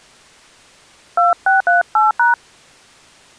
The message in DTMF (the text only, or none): 2638#